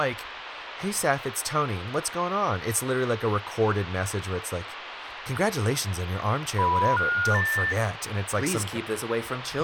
Telephone call progress tone (North American plan), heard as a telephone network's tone, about 980, 1430, 1800 Hz, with phone line noise and speech in English. Special information tone.